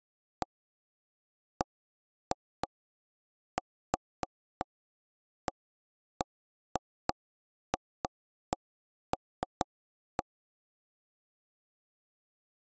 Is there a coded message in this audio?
No, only irregular taps on a table.